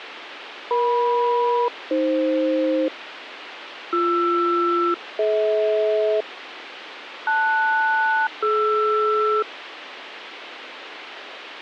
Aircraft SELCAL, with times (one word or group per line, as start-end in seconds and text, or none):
0.7-2.9 EM-AF
3.9-6.2 BR-DH
7.3-9.4 LS-DR